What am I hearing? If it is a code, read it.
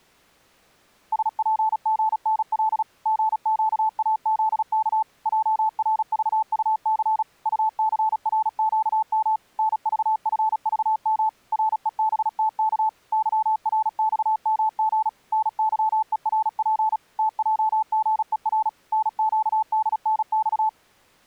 Morse code, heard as a keyed tone, machine-sent, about 36 wpm, 870 Hz. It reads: SPGNL GQAZK JRVUC UCRQM NVFVM REBTK YRXMG NYERP TJGER NQDNX